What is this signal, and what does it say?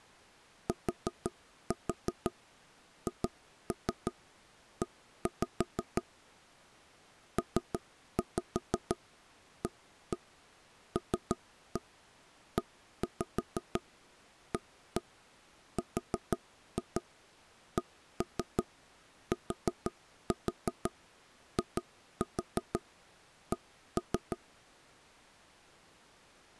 Tap code, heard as knocks on wood, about 6 knocks a second. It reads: THE PALEARCTIC